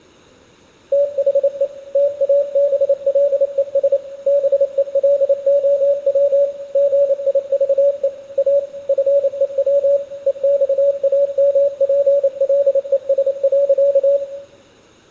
Morse code, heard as a keyed tone, machine-sent, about 28 wpm, 570 Hz, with room echo. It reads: THE TABLES BELOW GIVE A FEW EXAMPLES.